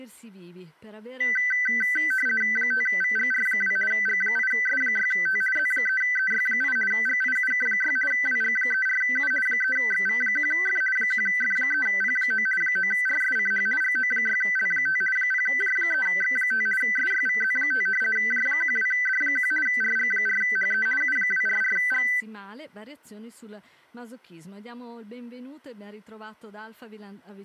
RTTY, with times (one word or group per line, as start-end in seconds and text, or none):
2.6-3.8 5VGR2
3.9-5.4 G8S6T
5.6-6.8 Z3EY8
6.9-8.0 GIUK6
8.1-9.3 WG34U
9.5-10.8 3XV1F
11.0-12.5 1F3P9
12.6-13.7 9RSCH
13.8-15.0 GO6L5
15.2-16.7 0J3X5
16.8-17.9 SYVZ5
18.2-19.5 J12D1
19.7-20.9 RG4HE
21.0-22.1 U244G